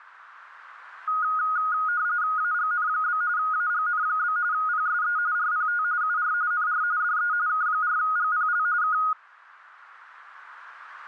RTTY (45.45 baud, 170 Hz shift), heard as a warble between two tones, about 1350 Hz centre, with radio static. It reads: AGN? AGN? PSE RPT UR NR DE K4GPL K